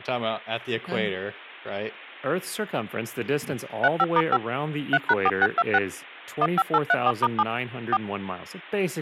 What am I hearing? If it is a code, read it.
DTMF, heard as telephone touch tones, dialled by machine, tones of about 50 ms, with speech in English. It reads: 35*5 3#4626 15834*7 4